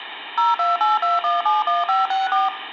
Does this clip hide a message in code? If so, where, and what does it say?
Yes: DTMF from 0.4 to 2.5 s, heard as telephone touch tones, dialled by machine, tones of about 170 ms, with phone line noise and room echo. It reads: 0282171564